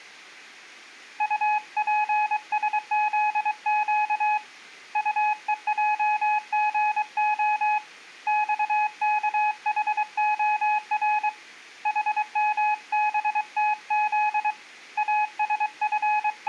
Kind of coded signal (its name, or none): Morse code